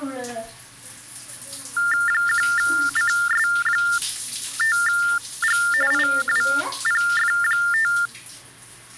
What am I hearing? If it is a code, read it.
TTY/TDD text telephone tones (45.45 baud Baudot), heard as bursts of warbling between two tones, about 400 Hz shift, 1600 Hz centre, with the noise of a restroom. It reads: 1CS5G IWPF5